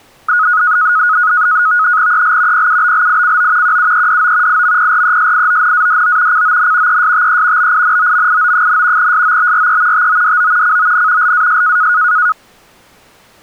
NAVTEX (SITOR-B), 100 baud, 170 Hz shift, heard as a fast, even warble, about 1360 Hz centre. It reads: EL PUBLICO QUEDO IMPRESIONADO CON ESTE BINOMIO, SOBRE TODO CON LAS